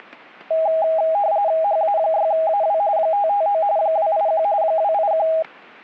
RTTY (45.45 baud, 170 Hz shift), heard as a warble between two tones, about 730 Hz centre. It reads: HA6AW 559 281 281